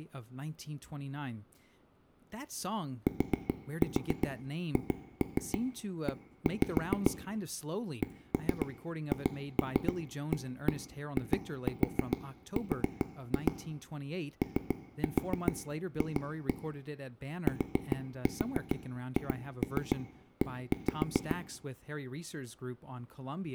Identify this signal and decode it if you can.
Tap code, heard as taps on a table, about 7 knocks a second, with room echo and speech in English. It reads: THE CHAIR OF THE